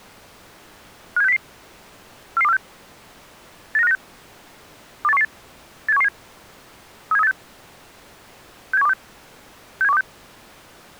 Five-tone selective call (EEA), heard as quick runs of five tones, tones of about 40 ms. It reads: 57600 44246 89596 28118 87117 37386 67126 67126